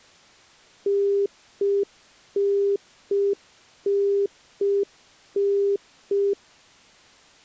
Telephone call progress tone (UK plan), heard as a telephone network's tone, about 400 Hz. Congestion tone.